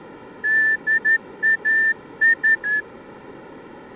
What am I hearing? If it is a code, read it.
Morse code, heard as a whistle, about 11 wpm, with room echo. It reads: DAS